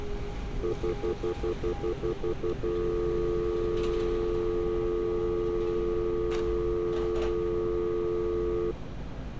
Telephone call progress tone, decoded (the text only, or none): stutter dial tone